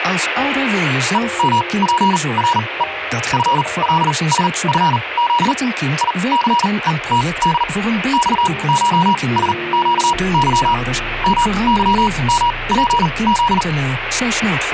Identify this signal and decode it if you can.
Morse code (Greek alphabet), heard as a keyed tone, machine-sent, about 39 wpm, spaced as for 26 wpm, 960 Hz, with radio static. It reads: ΕΜΠΡΕ ΦΛΣΦΖ ΙΘΕΤΔ ΞΧΣΨΥ ΜΥΜΠΖ